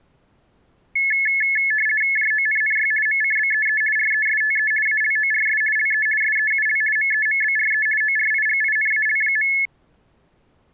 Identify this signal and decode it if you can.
RTTY (50 baud, 450 Hz shift), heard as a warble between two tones, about 1950 Hz centre. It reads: JONNY MCBEE RESTE ALORS LE SEUL MEMBRE ORIGINAL.